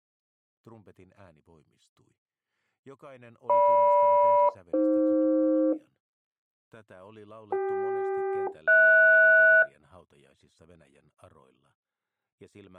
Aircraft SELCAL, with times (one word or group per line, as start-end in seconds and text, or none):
3.5-5.7 GM-AF
7.5-9.6 CK-HS